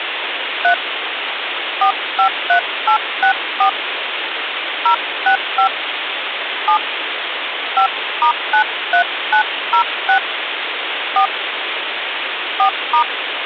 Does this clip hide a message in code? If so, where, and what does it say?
Yes: DTMF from 0.6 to 13.0 s, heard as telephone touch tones, dialled by hand, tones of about 100 ms, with phone line noise. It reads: 3 453864 065 7 5*93906 4 4*